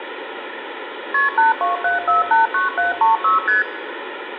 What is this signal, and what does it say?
Multi-frequency trunk signalling (R1, as on North American trunks), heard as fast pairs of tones, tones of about 150 ms, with phone line noise and room echo. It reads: KP 827489736 ST